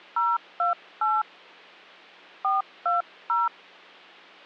DTMF, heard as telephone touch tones, dialled by hand, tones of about 180 ms. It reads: 028 420